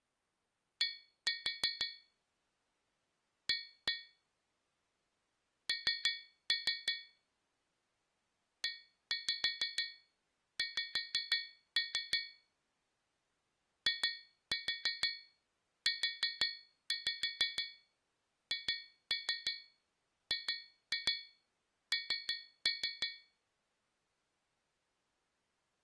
Tap code, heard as taps on a metal pipe, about 6 knocks a second. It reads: D A N EX IUHGN